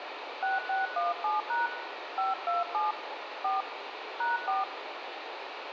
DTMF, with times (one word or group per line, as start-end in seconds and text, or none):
0.4-1.7 6617#
2.2-2.9 527
3.4-3.6 4
4.2-4.6 #4